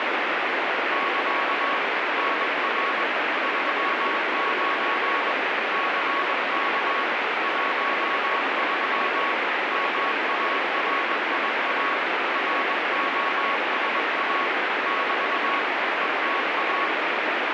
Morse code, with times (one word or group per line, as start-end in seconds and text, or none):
0.9-1.8 <KA>
2.2-3.0 NR
3.4-5.3 39
5.7-7.0 CK
7.4-9.3 13
9.7-11.9 MARIA
12.3-14.5 ROSA
14.9-15.6 <BT>
16.0-16.9 ETA